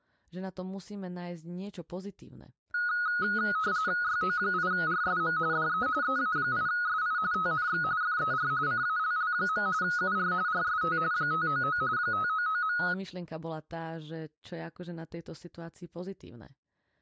RTTY (45.45 baud, 170 Hz shift), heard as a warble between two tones, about 1360 Hz centre, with speech in Slovak. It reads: YO8RSM DE EA8SI TNX FER CALL. UR RST 599 599.